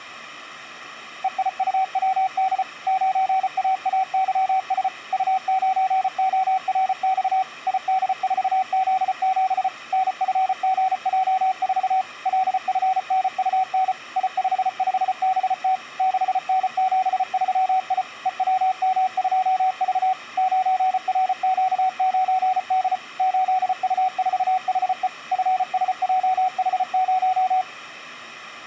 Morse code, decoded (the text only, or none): EIUWD 9AAYS U9ORX ID4Z7 NFGJ4 LFNUN I55BT 6N73I EWM2V 9RQ9D 8U4HE FSJH0